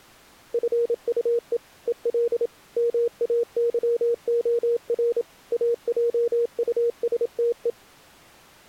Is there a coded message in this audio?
Yes: Morse code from 0.5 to 7.8 s, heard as a keyed tone, machine-sent, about 27 wpm, 470 Hz. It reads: FUE EL MAYOR AJUSTE